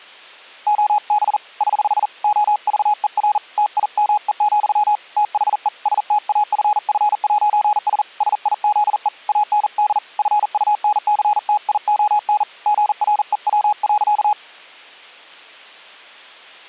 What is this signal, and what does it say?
Morse code, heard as a keyed tone, hand-sent with a paddle, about 40 wpm, 840 Hz. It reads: OB <HH> OVER TIME, THE STAFF'S SIZE AND FUNCTION GREW.